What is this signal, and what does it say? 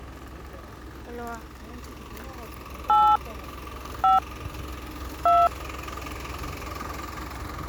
DTMF, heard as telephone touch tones, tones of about 210 ms, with street noise. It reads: 8 5 2